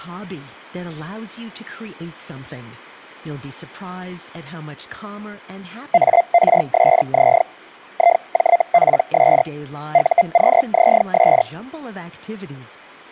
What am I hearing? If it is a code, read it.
Hellschreiber (Feld-Hell, 122.5 baud), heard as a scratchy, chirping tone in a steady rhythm, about 690 Hz, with speech in English. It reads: ARSZ IJPS UQZS